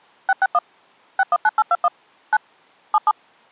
DTMF, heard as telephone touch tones, dialled by machine, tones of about 40 ms. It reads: 661 619821 9 77